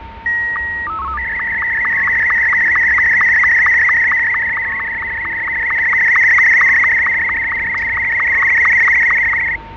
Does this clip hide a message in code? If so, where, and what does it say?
Yes: SSTV (slow-scan television), Martin M2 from 0.3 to 9.6 s, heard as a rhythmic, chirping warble, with radio static, fading, static crashes, a steady whistle near 910 Hz and the noise of a residential street.